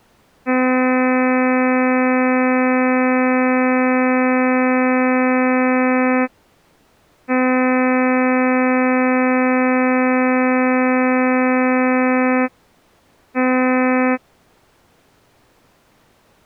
Ship horn signal, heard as a ship's horn, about 260 Hz. 2 long, 1 short. At sea: I intend to overtake on your starboard side.